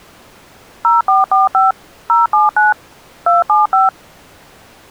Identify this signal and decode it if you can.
DTMF, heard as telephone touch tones, dialled by machine, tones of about 160 ms. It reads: 0445 079 275